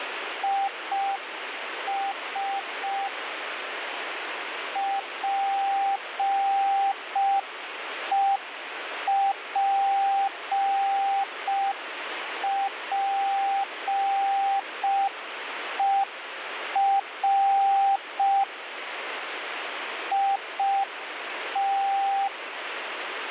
Morse code, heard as a keyed tone, machine-sent, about 5 wpm, 790 Hz, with radio static. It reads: IS PEPPER IT